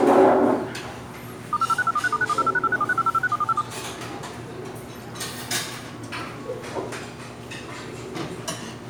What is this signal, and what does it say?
DTMF, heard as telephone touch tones, dialled by machine, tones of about 40 ms, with the noise of a restaurant. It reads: *506243*9108#837650561457